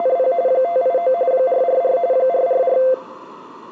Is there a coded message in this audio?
Yes: RTTY (45.45 baud, 170 Hz shift) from 0.0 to 2.9 s, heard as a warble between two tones, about 600 Hz centre. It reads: … 589 444 444